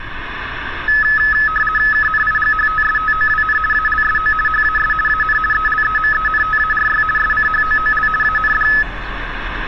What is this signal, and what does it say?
RTTY (50 baud, 450 Hz shift), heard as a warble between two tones, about 1500 Hz centre, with radio static and street noise. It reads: KNIGHTSTOWN ALSO HAS AN ELEMENTARY SCHOOL AND